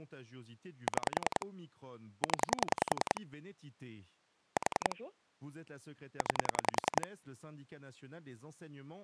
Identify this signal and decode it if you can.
Pulse dialling, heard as clicks on a phone line, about 10 pulses a second, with speech in French. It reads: 6 0 4 9